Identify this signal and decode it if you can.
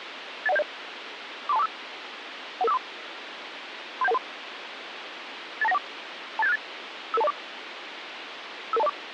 Five-tone selective call (EIA), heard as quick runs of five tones, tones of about 30 ms, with radio hiss. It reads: 81070 43245 11543 37113 82914 28768 55204 55204